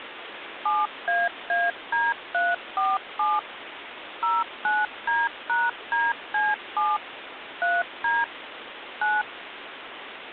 DTMF, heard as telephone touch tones, dialled by machine, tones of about 200 ms, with phone line noise. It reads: 7AAD347 09D#DC7 3D 9